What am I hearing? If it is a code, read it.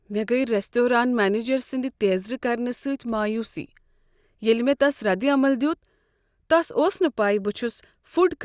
Speech in Kashmiri. There is no code.